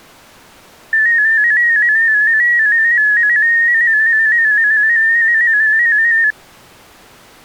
Multi-tone FSK (Olivia or MFSK type), about 250 Hz wide, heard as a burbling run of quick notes, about 15.625 baud.